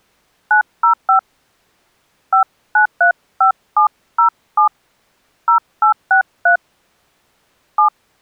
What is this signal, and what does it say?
DTMF, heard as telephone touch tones, dialled by hand, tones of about 110 ms. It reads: 905 5935707 0863 7